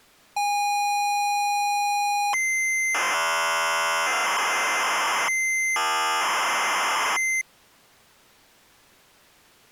ZX Spectrum tape loading, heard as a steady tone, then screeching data.